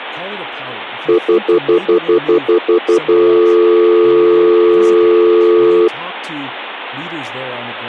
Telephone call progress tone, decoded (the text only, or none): stutter dial tone